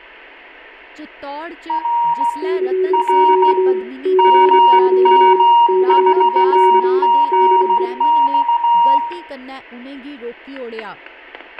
Morse code, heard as two keyed tones, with fading, static crashes, room echo and speech in Dogri. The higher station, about 16 wpm, 940 Hz: R R MM4GX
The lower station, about 25 wpm, 370 Hz: CQ CQ CQ DE